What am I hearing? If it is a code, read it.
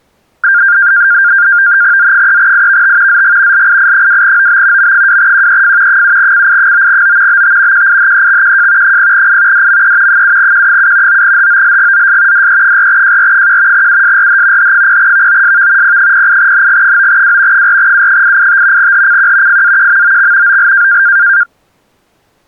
NAVTEX (SITOR-B), 100 baud, 170 Hz shift, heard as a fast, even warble, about 1500 Hz centre. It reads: Z3IVT ZG LII2OB M2QEF 7CI9O BT QIHEXQJ 0I DME 7Q7 9HOLGZS DE4JR1 USRH H0VOSV P08NG9W 4U885 HCQ FAQMOX OL